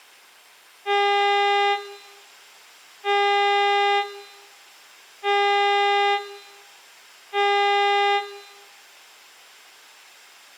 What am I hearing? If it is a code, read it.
Ship horn signal, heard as a ship's horn, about 400 Hz, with room echo. 4 short. At sea: a pilot vessel's identity signal in fog.